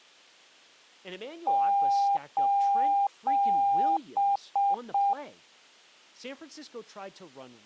Beep code, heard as beeps, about 800 Hz, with speech in English. 3 long, 3 short.